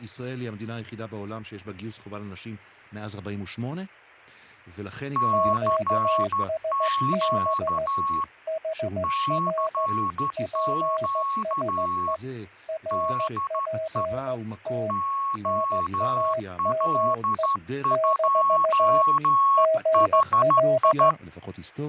Morse code, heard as two keyed tones, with fading and speech in Hebrew. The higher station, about 13 wpm, 1100 Hz: CQ CQ DE OL2HI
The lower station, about 15 wpm, 640 Hz: QSB HR PSE RPT NAME - GL